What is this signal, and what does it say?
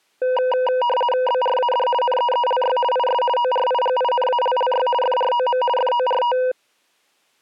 RTTY (50 baud, 450 Hz shift), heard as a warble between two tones, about 730 Hz centre. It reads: BRAD NEELY IS ORIGINALLY FROM FORT